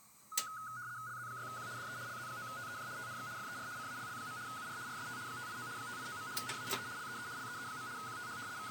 RTTY (75 baud, 170 Hz shift), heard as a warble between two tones, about 1360 Hz centre, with kitchen noise. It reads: LZ6Q DE LZ9TEJ TNX FER CALL. UR RST 589 589. NAME LEE LEE. QTH …